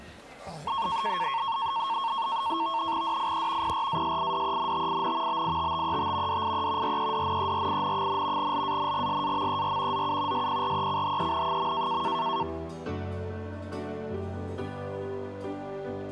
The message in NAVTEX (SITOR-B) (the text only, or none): DIE PRASIDENTIN BITTET DIE REDNERIN, LANGSAMER ZU SPRECHEN.